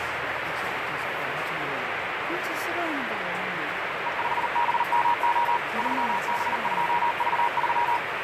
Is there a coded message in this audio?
Yes: Morse code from 4.0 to 8.0 s, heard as a keyed tone, machine-sent, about 39 wpm, 950 Hz, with heavy radio static and the noise of a crowd indoors. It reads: E5BMO 3B2V3